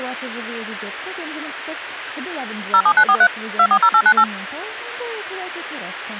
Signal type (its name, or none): DTMF